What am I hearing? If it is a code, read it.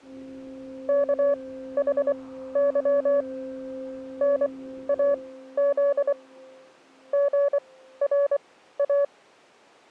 Morse code, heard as a keyed tone, machine-sent, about 24 wpm, spaced as for 14 wpm, 570 Hz. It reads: KHY NAZ GRA